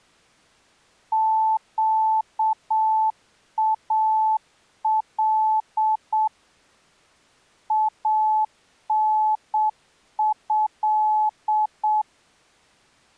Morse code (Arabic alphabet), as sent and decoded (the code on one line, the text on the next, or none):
--.- .- .-.. / .- -. ..-..
قال انه